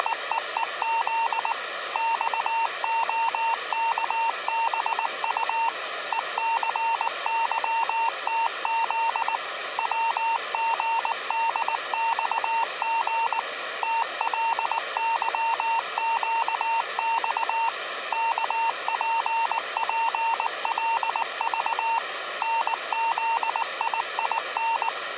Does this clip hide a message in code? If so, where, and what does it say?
Yes: Morse code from 0.0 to 24.9 s, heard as a keyed tone, machine-sent, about 19 wpm, 910 Hz. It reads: … XOKBU ECYTZ WGDXG TLYQX KPPLV NZIIN